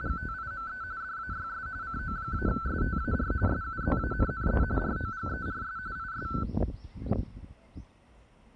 RTTY (45.45 baud, 170 Hz shift), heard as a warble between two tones, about 1420 Hz centre, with the noise of a residential street. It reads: … DAYS CO-STAR SUZANNE ROGERS IS